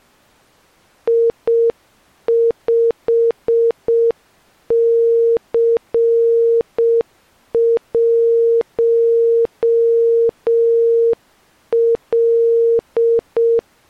Morse code, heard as a keyed tone, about 6 wpm, 460 Hz. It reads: I5C1L